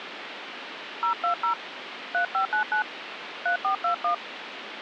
DTMF, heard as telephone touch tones, dialled by hand, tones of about 100 ms, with phone line noise. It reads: 020 3599 3421